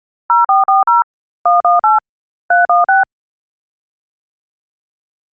DTMF, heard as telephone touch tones, dialled by machine, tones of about 150 ms. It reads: 0440 118 316